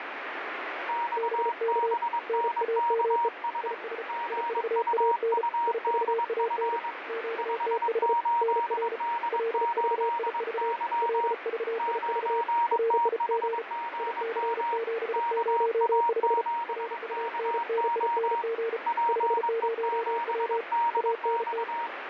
Morse code, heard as two keyed tones, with radio static. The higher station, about 22 wpm, 940 Hz: XBNKS GUUDF 58D8Y 9THGM KA7KO PE7DX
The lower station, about 34 wpm, 460 Hz: BK NAME IS IVAN IVAN QTH NR LVIV LVIV RIG IC705 RUNNING 50W ANT